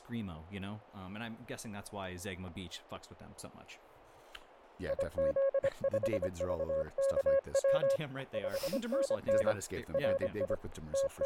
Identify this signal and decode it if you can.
Morse code, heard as a keyed tone, hand-sent with a paddle, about 25 wpm, 550 Hz, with fading, static crashes and speech in English. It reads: IZ5VKW 5NN RI …